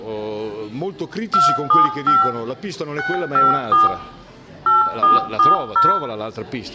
DTMF, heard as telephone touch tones, dialled by machine, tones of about 160 ms, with room echo. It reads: 275 654 8440